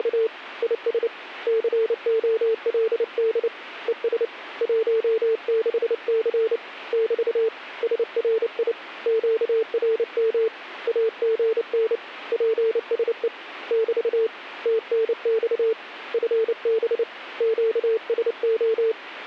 Morse code, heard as a keyed tone, hand-sent with a paddle, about 29 wpm, 440 Hz. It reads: … IS COLD ES 16C <BT> SRI QRM AGN PSE <BT> TNX FB QSO